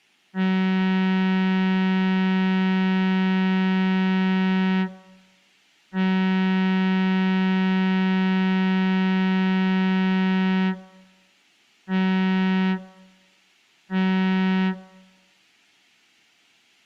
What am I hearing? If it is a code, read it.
Ship horn signal, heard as a ship's horn, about 190 Hz. 2 long, 2 short. At sea: I intend to overtake on your port side.